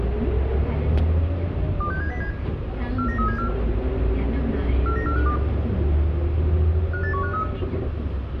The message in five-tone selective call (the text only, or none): 26707 49374 49452 58153